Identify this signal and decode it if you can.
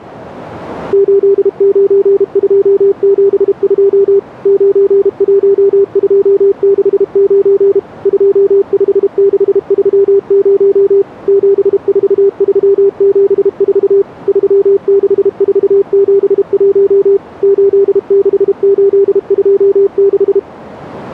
Morse code, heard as a keyed tone, machine-sent, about 32 wpm, 400 Hz. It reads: 89272 91269 25630 74374 36471 86826